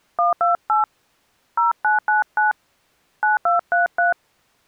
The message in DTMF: 128 0999 9233

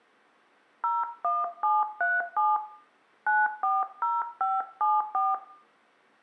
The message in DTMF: 01737 940574

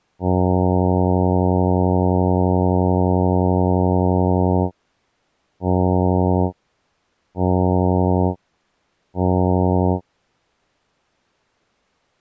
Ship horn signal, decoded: 1 long, 3 short

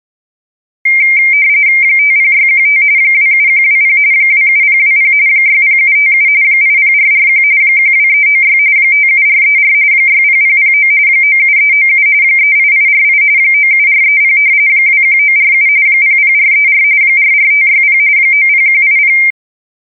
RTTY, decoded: 50615 27120 27020 60757 80441 12396 57434 60009 97397 38848 97430 21947 00434 44560 90180

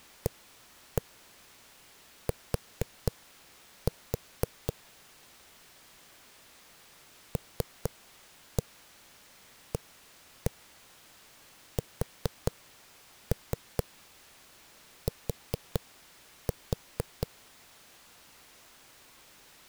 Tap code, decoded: AT LAST

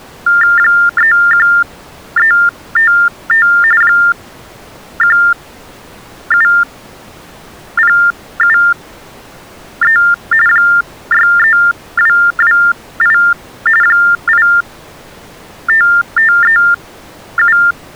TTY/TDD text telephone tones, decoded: 31355 17073 63228 85537

